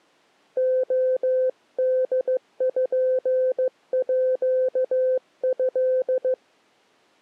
Morse code (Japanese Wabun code), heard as a keyed tone, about 15 wpm, 510 Hz. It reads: レポート